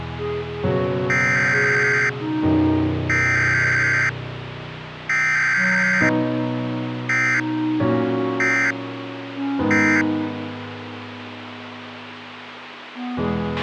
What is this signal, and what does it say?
Emergency Alert System (SAME) tones (header bursts, then end-of-message bursts), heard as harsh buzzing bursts, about 520.83 baud, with radio hiss and a squelch burst at the end.